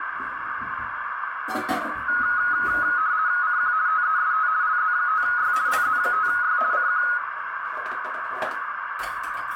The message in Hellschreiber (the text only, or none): none